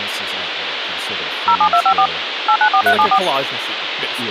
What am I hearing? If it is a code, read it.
DTMF, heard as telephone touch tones, dialled by machine, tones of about 80 ms, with phone line noise and speech in English. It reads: 07254 894374